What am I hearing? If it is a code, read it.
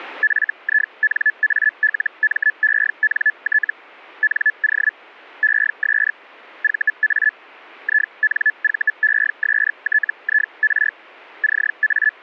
Hellschreiber (Feld-Hell, 122.5 baud), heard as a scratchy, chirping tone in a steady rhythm, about 1700 Hz. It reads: FINALMENT NO ES VA INVESTIR …